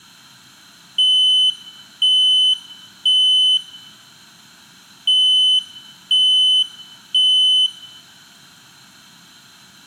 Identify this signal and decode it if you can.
Alarm pattern, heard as an alarm's beeps, played twice, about 3050 Hz, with room echo. Temporal three. Smoke or fire, evacuate.